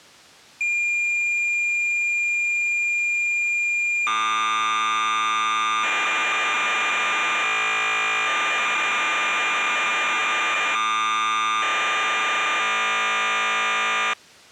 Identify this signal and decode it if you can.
Cassette data (Kansas City type), 1200 baud, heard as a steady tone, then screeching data.